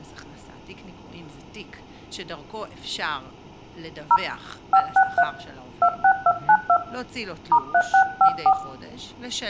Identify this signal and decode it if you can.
DTMF, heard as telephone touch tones, dialled by hand, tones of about 70 ms, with room echo and speech in Hebrew. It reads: 0 563 26292 *3654